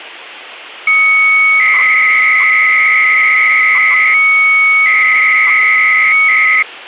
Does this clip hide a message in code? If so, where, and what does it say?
Yes: 300-baud modem data (Bell 103 tones) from 0.9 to 6.6 s, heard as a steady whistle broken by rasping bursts, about 300 baud, 200 Hz shift.